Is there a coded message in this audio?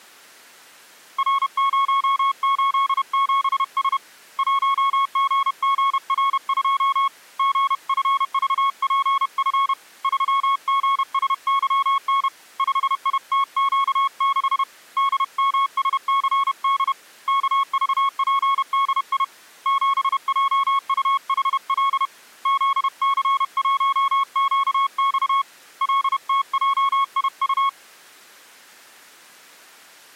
Yes: Morse code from 1.1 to 27.8 s, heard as a keyed tone, hand-sent with a paddle, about 31 wpm, 1100 Hz. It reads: R087S 1GGR2 GFVPF 3GSYN 5ITQ6 DMSCD KVPDI 7JUHL ZC1QX LTJIU